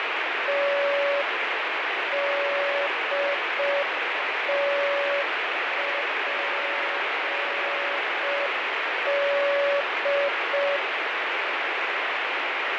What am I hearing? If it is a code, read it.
Morse code, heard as a keyed tone, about 5 wpm, 570 Hz, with heavy radio static and fading. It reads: TDTPD